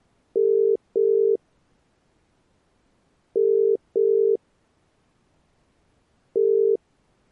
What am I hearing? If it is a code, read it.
Telephone call progress tone (as in the UK, Ireland, Australia and similar networks), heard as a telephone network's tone, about 400, 450 Hz. Ringback tone.